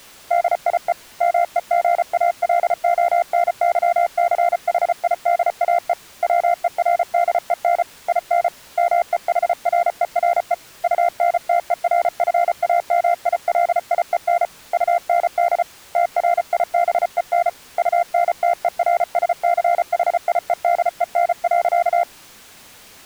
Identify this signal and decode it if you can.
Morse code, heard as a keyed tone, hand-sent with a paddle, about 34 wpm, 690 Hz. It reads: DIE MEGALONYCHIDAE WERDEN IN MEHRERE UNTERFAMILIEN UND TRIBEN UNTERSCHIEDEN.